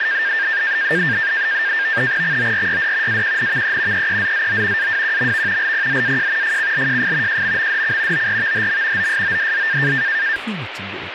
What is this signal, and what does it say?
NAVTEX (SITOR-B), 100 baud, 170 Hz shift, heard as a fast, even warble, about 1700 Hz centre, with radio static and speech in Manipuri. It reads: XORYD AQNVE EEZZO AWQMV LPZAJ FCLJF JMMDC ORVHM OSODZ